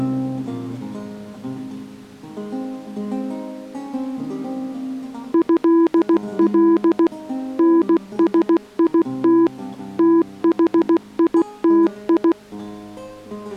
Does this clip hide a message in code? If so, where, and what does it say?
Yes: Morse code (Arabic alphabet) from 5.3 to 12.4 s, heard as a keyed tone, machine-sent, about 16 wpm, 330 Hz. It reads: هل نسيت تحيتي